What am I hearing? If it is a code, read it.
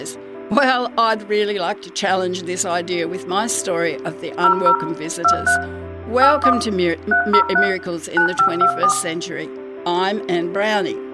DTMF, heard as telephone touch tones, dialled by machine, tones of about 90 ms, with room echo. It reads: 00 23 81 303 9524